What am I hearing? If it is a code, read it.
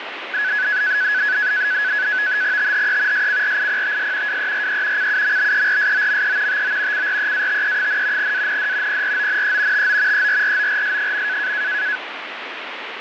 NAVTEX (SITOR-B), 100 baud, 170 Hz shift, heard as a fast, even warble, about 1600 Hz centre, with radio static. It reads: THE SCRIPTS WERE CUMBERSOME TO CREATE, AND PRONE TO ERRORS.